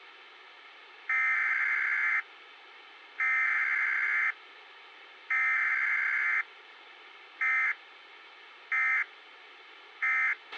Emergency Alert System (SAME) tones (header bursts, then end-of-message bursts), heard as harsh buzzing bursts, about 520.83 baud, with a squelch burst at the end.